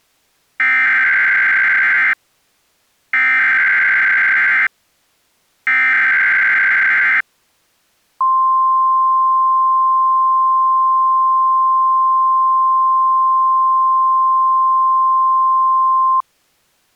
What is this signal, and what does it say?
Emergency Alert System (SAME) tones (header bursts, then the 1050 Hz attention tone), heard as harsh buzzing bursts, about 520.83 baud.